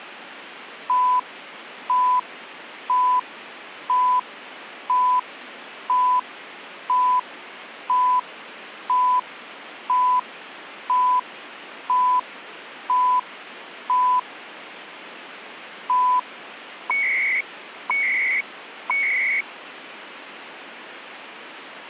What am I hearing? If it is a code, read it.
Radio time signal (CHU, Canada), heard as beeps and data bursts, one a second, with radio static.